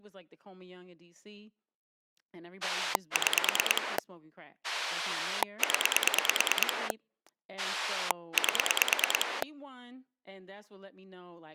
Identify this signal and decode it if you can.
Pulse dialling, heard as a rotary dial, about 9 pulses a second, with speech in English. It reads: 6 0 8